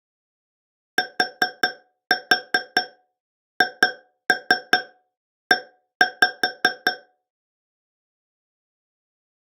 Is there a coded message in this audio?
Yes: tap code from 1.0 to 7.0 s, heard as taps on a metal pipe, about 5 knocks a second. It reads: THE